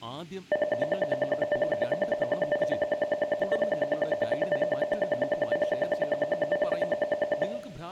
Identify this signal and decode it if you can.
Radio time signal (RWM, Moscow), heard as ten pulses a second, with room echo and speech in Malayalam.